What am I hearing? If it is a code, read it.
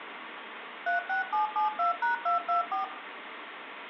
DTMF, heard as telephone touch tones, dialled by machine, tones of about 130 ms, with phone line noise. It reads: 36772#224